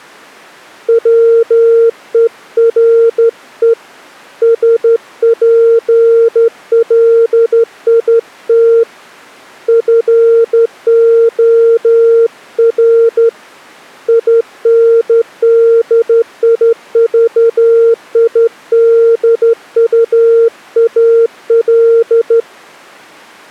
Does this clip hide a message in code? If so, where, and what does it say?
Yes: Morse code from 0.8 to 22.5 s, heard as a keyed tone, hand-sent with a straight key, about 12 wpm, 460 Hz. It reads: WERE SPLIT FOR INDIVIDUAL